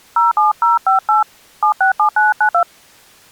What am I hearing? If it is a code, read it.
DTMF, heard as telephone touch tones, dialled by hand, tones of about 130 ms. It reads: 07058 767992